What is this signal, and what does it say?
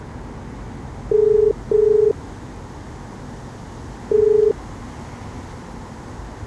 Telephone call progress tone (as in the UK, Ireland, Australia and similar networks), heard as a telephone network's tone, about 430 Hz, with the noise of a residential street. Ringback tone.